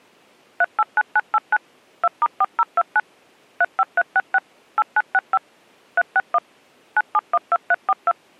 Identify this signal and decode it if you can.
DTMF, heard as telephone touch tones, dialled by machine, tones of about 40 ms. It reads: 389989 2*4029 35366 8965 361 9712342